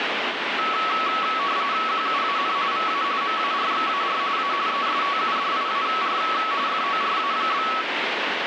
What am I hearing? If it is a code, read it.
RTTY (45.45 baud, 170 Hz shift), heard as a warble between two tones, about 1210 Hz centre, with radio static. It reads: QUAN VA MARXAR A ESTUDIAR FORA?